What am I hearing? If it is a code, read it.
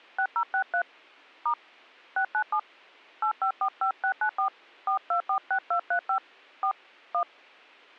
DTMF, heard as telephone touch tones, dialled by hand, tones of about 90 ms. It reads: 6063 * 697 8545694 4246235 4 1